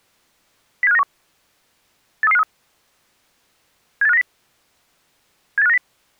Five-tone selective call (EEA), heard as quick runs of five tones, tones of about 40 ms. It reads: 07591 83353 78590 78590